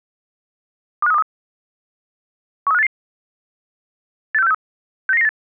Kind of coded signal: five-tone selective call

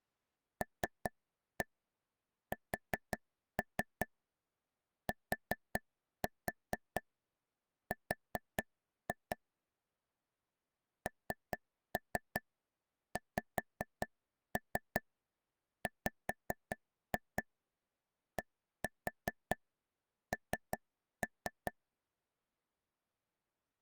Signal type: tap code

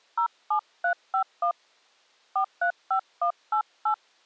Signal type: DTMF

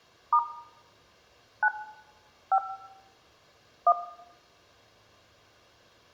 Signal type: DTMF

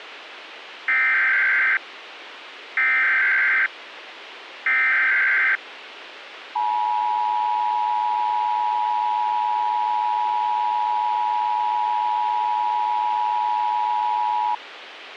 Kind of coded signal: Emergency Alert System (SAME) tones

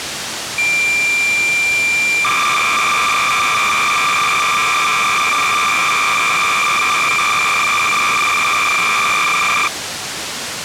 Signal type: cassette data (Kansas City type)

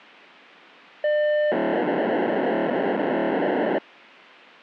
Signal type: POCSAG pager data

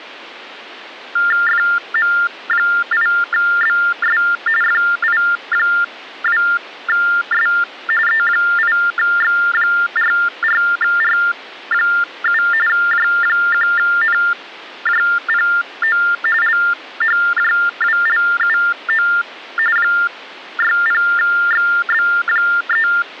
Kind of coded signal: TTY/TDD text telephone tones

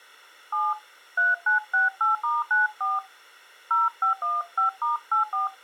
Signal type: DTMF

